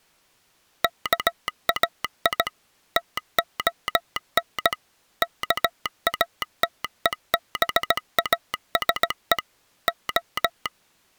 Morse code (Greek alphabet), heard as a telegraph sounder, machine-sent, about 17 wpm. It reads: ΚΑΙ ΤΟΝ ΚΑΤΕΒΑΣΕ Ο